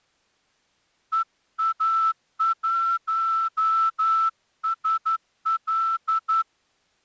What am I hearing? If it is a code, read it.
Morse code, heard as a whistle, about 11 wpm. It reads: EA1SL